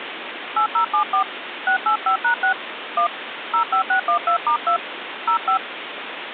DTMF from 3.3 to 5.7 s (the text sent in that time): 05612*2 05